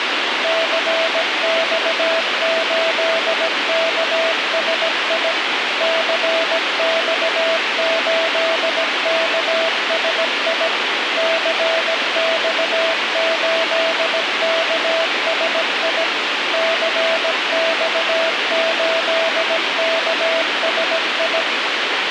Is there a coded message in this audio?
Yes: Morse code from 0.4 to 21.5 s, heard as a keyed tone, machine-sent, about 17 wpm, 660 Hz, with radio hiss. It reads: CX8KSI CX8KSI CX8KSI CX8KSI